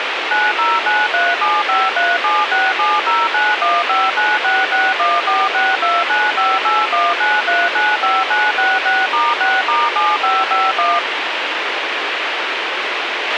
DTMF, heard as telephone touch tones, dialled by machine, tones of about 210 ms, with radio hiss and a squelch burst at the end. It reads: 90937537670915966146295819395966*6*7551